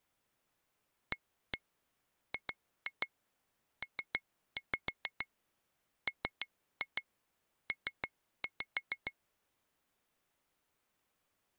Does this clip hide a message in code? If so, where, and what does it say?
Yes: tap code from 1.1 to 9.1 s, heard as taps on glass, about 6 knocks a second. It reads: AGPMP